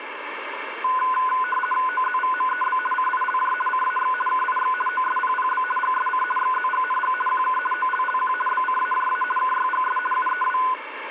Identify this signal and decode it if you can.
RTTY (50 baud, 450 Hz shift), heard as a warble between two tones, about 1250 Hz centre, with radio static. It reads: OZVMEB CILJ CAX KIX OSPPB GSC XZGNG QK OLLQ BCAJA KYGS UEW